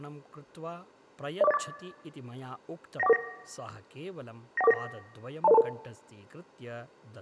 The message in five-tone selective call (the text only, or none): 04084 91449 91449 20022